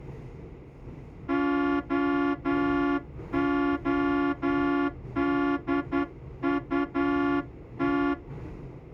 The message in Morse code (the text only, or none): OODUT